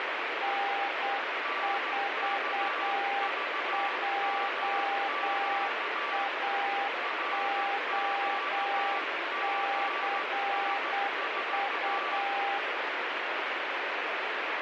Morse code, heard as two keyed tones, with heavy radio static. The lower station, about 8 wpm, 800 Hz: N4JAOCU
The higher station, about 15 wpm, 1160 Hz: NKVMQ RQGS4